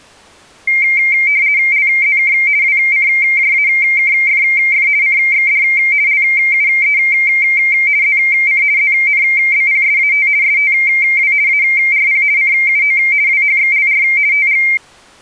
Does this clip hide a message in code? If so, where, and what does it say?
Yes: RTTY (50 baud, 170 Hz shift) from 0.7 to 14.8 s, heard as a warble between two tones, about 2200 Hz centre. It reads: LZK WCJAKFF CXD LUE ZC ZNBPSAT STW ARP CUO WHXLR TG